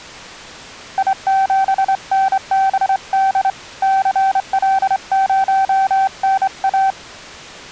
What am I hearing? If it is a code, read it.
Morse code, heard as a keyed tone, hand-sent with a straight key, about 26 wpm, 770 Hz. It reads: I7NBD CL0NA